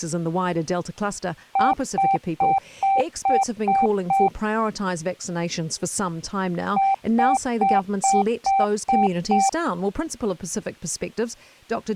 Beep code, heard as beeps, played twice, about 780 Hz, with speech in English. 7 short. In AMI BIOS tables: virtual mode exception error; in Dell tables: processor failure.